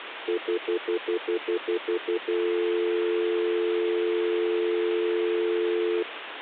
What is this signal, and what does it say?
Telephone call progress tone (North American plan), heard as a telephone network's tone, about 350, 440 Hz, 0.1 s on and 0.1 s off, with phone line noise. Stutter dial tone.